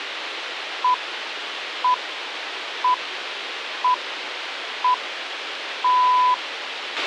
Radio time signal (six pips, as the Greenwich Time Signal), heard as pips, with radio hiss and a squelch burst at the end.